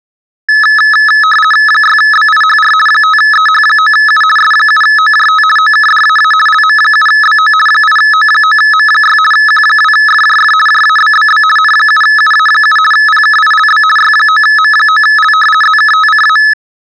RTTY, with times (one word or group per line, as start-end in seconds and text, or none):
1.7-2.7 6BIHR
2.9-4.2 5EH9U
4.4-5.4 S7OJT
5.6-6.3 OKDAA
6.5-7.5 LM7BO
7.7-9.2 8O9M6
9.3-10.5 Q2FJF
10.7-11.4 JABBB
11.6-12.8 N7UA7
12.9-13.8 PKILB
14.0-15.3 Y9M9L
15.6-16.4 ZKTCA